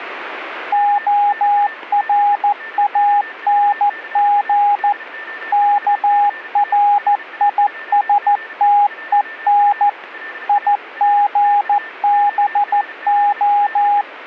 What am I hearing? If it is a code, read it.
Morse code, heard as a keyed tone, machine-sent, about 14 wpm, 820 Hz, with a weaker station near 1790 Hz. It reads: ORANG KRISTEN IGBO